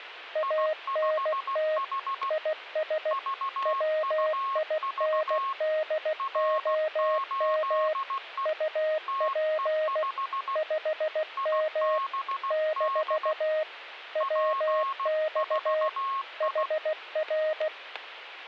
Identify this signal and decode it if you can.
Morse code, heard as two keyed tones, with static crashes. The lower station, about 16 wpm, 620 Hz: ANT IS WINDOM UP 5M - WX HR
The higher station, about 16 wpm, 1090 Hz: I5H VUV R8E TE5 IBD P4I